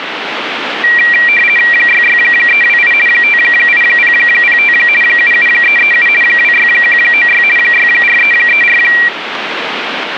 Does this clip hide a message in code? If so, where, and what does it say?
Yes: RTTY (50 baud, 450 Hz shift) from 0.8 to 9.1 s, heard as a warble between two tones, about 2150 Hz centre, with radio static. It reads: 66328 58005 77337 26196 64334